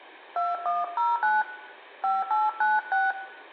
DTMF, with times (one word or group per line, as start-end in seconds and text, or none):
0.4-1.4 2109
2.0-3.1 5896